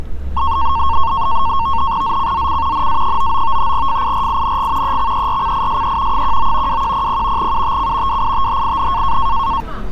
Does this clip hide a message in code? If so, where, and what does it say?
Yes: NAVTEX (SITOR-B), 100 baud, 170 Hz shift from 0.4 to 9.6 s, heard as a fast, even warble, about 1000 Hz centre, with street noise. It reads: ZCZC NA99 FIRING EXERCISE 19 2100 UTC WITHIN